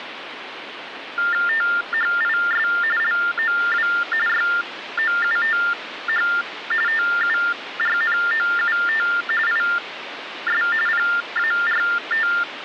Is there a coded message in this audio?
Yes: TTY/TDD text telephone tones (45.45 baud Baudot) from 1.2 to 12.4 s, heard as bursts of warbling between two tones, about 400 Hz shift, 1600 Hz centre, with phone line noise. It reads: THIS LOW YOUTH TURNOUT IS PART